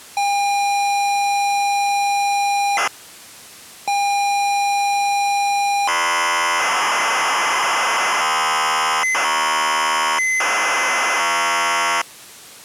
ZX Spectrum tape loading, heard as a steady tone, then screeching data.